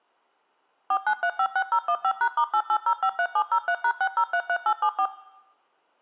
DTMF, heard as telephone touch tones, dialled by machine, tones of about 70 ms. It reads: 49356015#*88053703#6033874